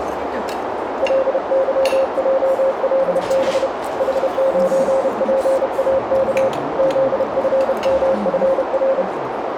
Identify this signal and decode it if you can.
Morse code, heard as a keyed tone, hand-sent with a paddle, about 31 wpm, 540 Hz, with radio static, a narrow filter and the noise of a restaurant. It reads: LYJLB H9PAK ZFMFR